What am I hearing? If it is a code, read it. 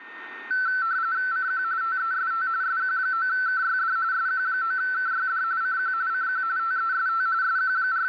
RTTY (45.45 baud, 170 Hz shift), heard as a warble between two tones, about 1430 Hz centre, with radio static and a steady whistle near 1830 Hz. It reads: CQ TEST SQ9KYD SQ9KYD CQ CQ TEST …